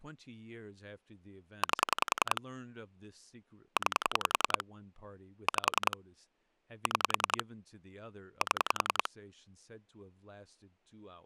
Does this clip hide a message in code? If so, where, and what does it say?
Yes: pulse dialling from 1.6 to 9.1 s, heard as clicks on a phone line, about 10 pulses a second, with speech in English. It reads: 8 9 5 6 7